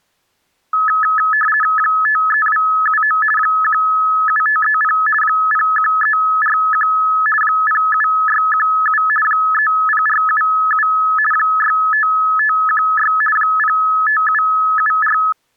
RTTY (50 baud, 450 Hz shift), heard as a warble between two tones, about 1500 Hz centre. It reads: 53279 17530 01341 07617 30477 65516 05774